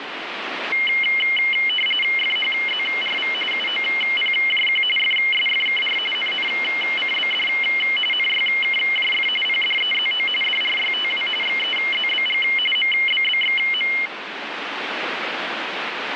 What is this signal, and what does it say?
RTTY (45.45 baud, 850 Hz shift), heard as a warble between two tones, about 2550 Hz centre, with radio static. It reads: FHZRV UOPJQ FSFKR NNCBD NYKJF PDEZO DRYTW XEZBG MBBXM